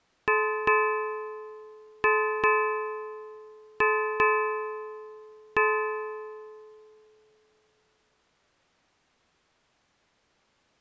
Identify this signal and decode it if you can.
Ship's bell, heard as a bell. 7. Seven half-hours of the watch have passed.